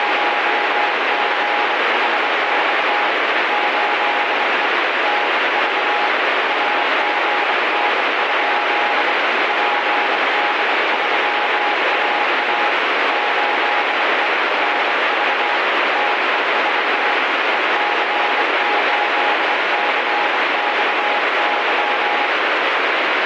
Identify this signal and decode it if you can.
Morse code, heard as a keyed tone, hand-sent with a bug key, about 24 wpm, 830 Hz, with heavy radio static. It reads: … 8E NV AGN? PD3AA 8E NV TEST EC8CXY